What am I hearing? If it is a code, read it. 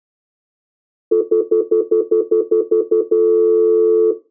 Telephone call progress tone (North American plan), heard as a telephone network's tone, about 350, 440 Hz, 0.1 s on and 0.1 s off. Stutter dial tone.